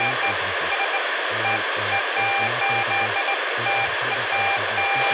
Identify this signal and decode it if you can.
Beeps of irregular length, with radio hiss, a squelch burst at the end and speech in Dutch. There is no code.